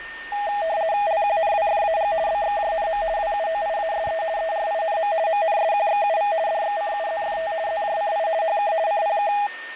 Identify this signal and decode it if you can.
RTTY (50 baud, 170 Hz shift), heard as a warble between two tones, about 740 Hz centre, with radio static, a steady whistle near 1820 Hz and the noise inside a lift. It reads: LQNWFAG BXJNM WUOIASE ERINM MNSQXUV DXCUZFT ZJCI HK CPK